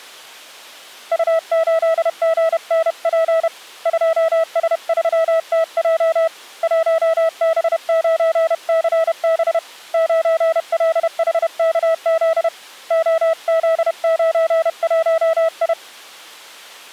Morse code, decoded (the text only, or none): U8GNP 2S3TJ 1B9CB 9LHKZ OZ91I